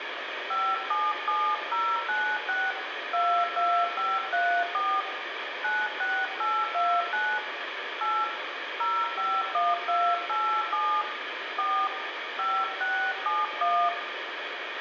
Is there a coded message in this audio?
Yes: DTMF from 0.5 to 13.9 s, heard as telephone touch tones, dialled by hand, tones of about 260 ms, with phone line noise and room echo. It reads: 577096 22534 96829 8 051287 4 5671